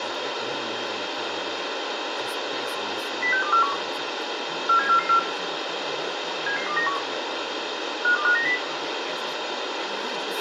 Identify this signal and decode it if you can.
Five-tone selective call (CCIR), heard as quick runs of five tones, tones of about 100 ms, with radio hiss, a squelch burst at the end, room echo and speech in English. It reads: 06241 47444 77291 52590